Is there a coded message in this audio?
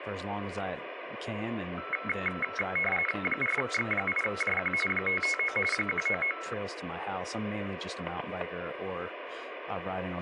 Yes: RTTY (45.45 baud, 850 Hz shift) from 1.8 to 6.5 s, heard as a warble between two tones, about 1750 Hz centre, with radio static, static crashes and speech in English. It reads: 4X8JQ 559 199